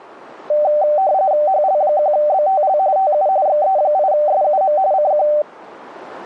RTTY (45.45 baud, 170 Hz shift), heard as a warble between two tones, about 680 Hz centre. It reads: HL1BTL TU XE8SUM CQ